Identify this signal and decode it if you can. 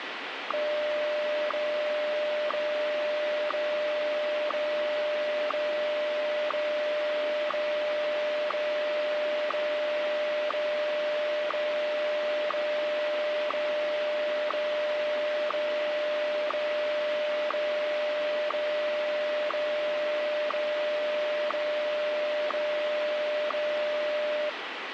Radio time signal (WWVH, Hawaii), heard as ticks, one a second, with radio static.